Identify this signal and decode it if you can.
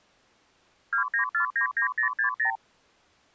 Multi-frequency trunk signalling (R2, with the far end's replies), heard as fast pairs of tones, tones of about 100 ms. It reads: 29499060